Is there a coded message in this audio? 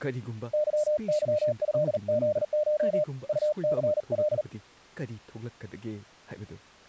Yes: Morse code (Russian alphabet) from 0.5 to 4.5 s, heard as a keyed tone, hand-sent with a paddle, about 39 wpm, 600 Hz, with speech in Manipuri. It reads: ЫЫЭЗШ УЦЛ